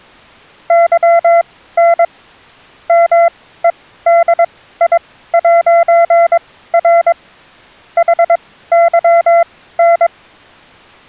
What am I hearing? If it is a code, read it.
Morse code, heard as a keyed tone, machine-sent, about 22 wpm, spaced as for 15 wpm, 680 Hz. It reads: YN MEDI'R HYN